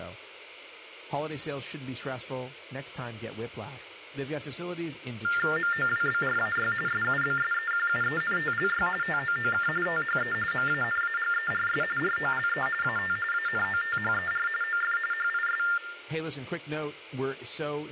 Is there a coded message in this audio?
Yes: TTY/TDD text telephone tones (45.45 baud Baudot) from 5.2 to 15.8 s, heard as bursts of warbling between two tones, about 400 Hz shift, 1600 Hz centre, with hum, room echo and speech in English. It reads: MOWBRAY SUBSEQUENTLY TOOK THE MANAGERS ROLE AT ANOTHER OF HIS